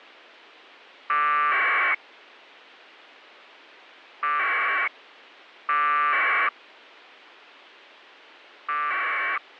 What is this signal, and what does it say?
Packet radio (AX.25, as in APRS), 1200 baud, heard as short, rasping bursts.